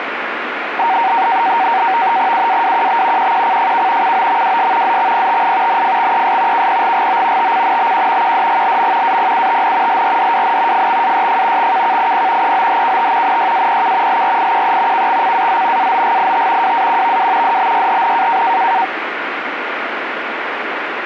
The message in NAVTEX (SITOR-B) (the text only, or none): UAWQB QQCFK COMWS ZXPTI NFXES KPGGO TCNBQ QDGLM APUTN LRDWN FXAYF XKKIP EOHKT NYAPK LRIQE KXCAZ AOGIT WAQVW DBYHN